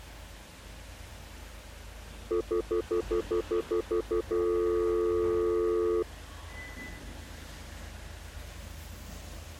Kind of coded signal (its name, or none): telephone call progress tone